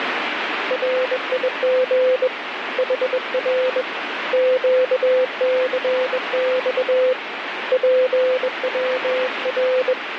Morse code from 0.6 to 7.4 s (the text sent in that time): RIG HR QCX